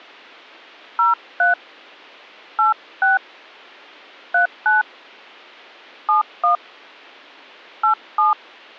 DTMF, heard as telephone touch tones, dialled by hand, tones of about 140 ms. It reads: 03 86 39 71 87